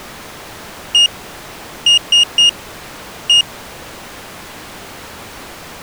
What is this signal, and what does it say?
Beep code, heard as a piezo beeper, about 2850 Hz. 1-3-1. In Phoenix BIOS tables: memory refresh failure.